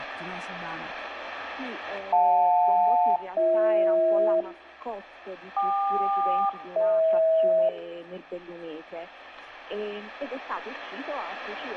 Aircraft SELCAL, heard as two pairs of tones, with radio static and room echo. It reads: JL-BH KQ-DH